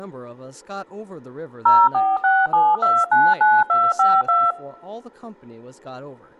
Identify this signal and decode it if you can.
DTMF, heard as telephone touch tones, dialled by machine, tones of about 220 ms, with speech in English. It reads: 0467299252